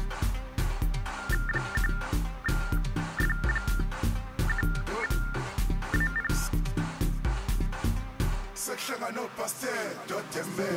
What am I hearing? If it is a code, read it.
TTY/TDD text telephone tones (45.45 baud Baudot), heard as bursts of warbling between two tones, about 400 Hz shift, 1600 Hz centre. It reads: 1F1AP